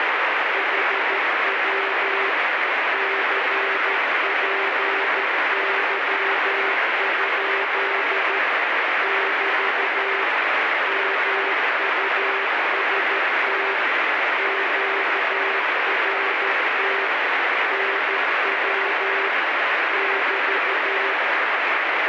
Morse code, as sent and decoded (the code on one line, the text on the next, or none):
.... .-- / -.-. .--. -.-- ..--.. / -...- / -- ..- ... - / --.- .-. - / -. .-- / -...-
HW CPY? <BT> MUST QRT NW <BT>